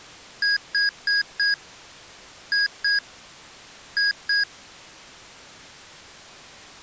Beep code, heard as beeps from a small speaker, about 1650 Hz. 4-2-2. In Phoenix BIOS tables: shutdown test failure.